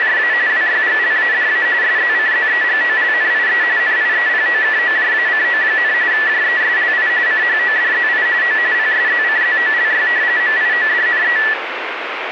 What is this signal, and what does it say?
RTTY (45.45 baud, 170 Hz shift), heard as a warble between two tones, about 1850 Hz centre, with radio static. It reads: … WYGLADA SZCZEGOLNIE NIEPOKOJACO, JESLI CHODZI O PSZCZOLY MIODNE